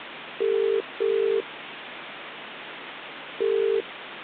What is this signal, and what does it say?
Telephone call progress tone (as in the UK, Ireland, Australia and similar networks), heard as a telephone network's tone, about 400, 450 Hz, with phone line noise. Ringback tone.